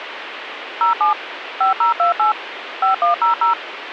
DTMF, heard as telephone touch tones, dialled by machine, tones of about 120 ms, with radio hiss. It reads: 07 5028 5100